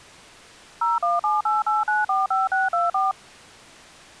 DTMF, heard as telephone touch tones, dialled by machine, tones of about 170 ms. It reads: 01788945624